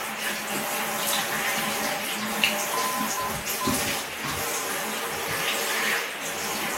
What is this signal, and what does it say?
Morse code, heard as a keyed tone, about 11 wpm, 1020 Hz, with radio static and the noise of a restroom. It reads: NE